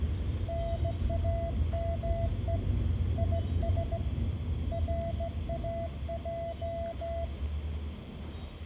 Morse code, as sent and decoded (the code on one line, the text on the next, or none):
-. .- -- . / .. ... / .-. .- .---
NAME IS RAJ